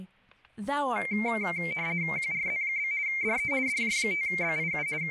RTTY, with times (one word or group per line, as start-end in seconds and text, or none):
2.2-2.9 QRZ?
3.1-3.5 DE
3.7-4.9 DJ5BIU
5.0-5.1 …